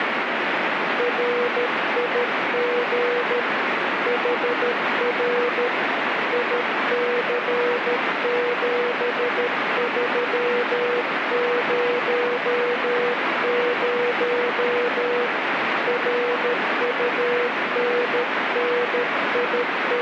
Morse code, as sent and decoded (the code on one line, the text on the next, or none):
.-. .. --. / .... .-. / .. -.-. --... ...-- ----- ----- / …
RIG HR IC7300 …